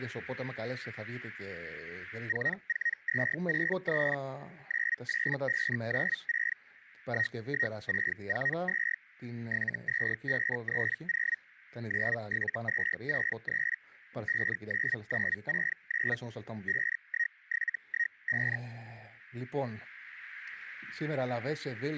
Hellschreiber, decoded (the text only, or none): 44263 98596 11642 72530 97263 59969 51715